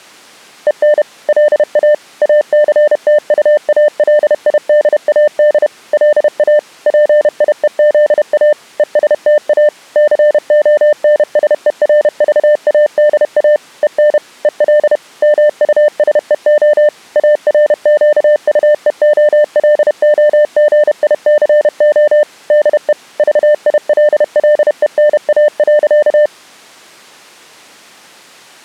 Morse code, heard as a keyed tone, machine-sent, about 31 wpm, 600 Hz. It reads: EN LA ACTUALIDAD LA PIEZA ESTA CONSERVADA EN EL MUSEO ARQUEOLOGICO DE VILLENA.